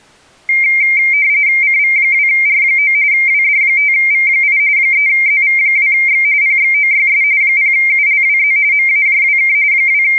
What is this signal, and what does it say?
RTTY (45.45 baud, 170 Hz shift), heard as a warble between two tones, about 2200 Hz centre. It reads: CV2R9 WD5V8 3ZV2X PXOYS 0ULWZ MAJWK …